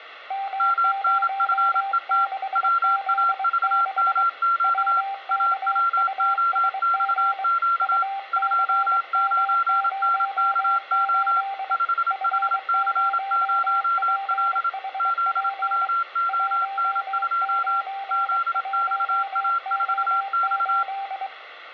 Morse code, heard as two keyed tones, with radio static and room echo. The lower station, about 23 wpm, 780 Hz: M06Z6 WKUSG UCM08 F0PHP 191O8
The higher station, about 27 wpm, 1370 Hz: MNFET WAVMQ AWOXQ 29NKO 5HC0L ZWON2 ZXA4X